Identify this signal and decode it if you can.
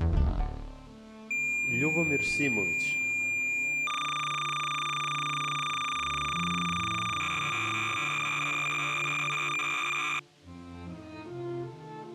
Cassette data (Kansas City type), 300 baud, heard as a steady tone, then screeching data.